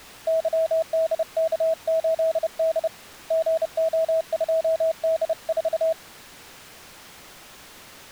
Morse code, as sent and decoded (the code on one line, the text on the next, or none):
-.-- -.. -.- ---.. -.. / --. --- ..--- -.. ....-
YDK8D GO2D4